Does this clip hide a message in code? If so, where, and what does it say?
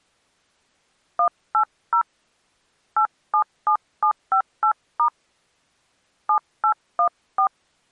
Yes: DTMF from 1.2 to 7.5 s, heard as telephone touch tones, dialled by hand, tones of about 90 ms. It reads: 180 877758* 7814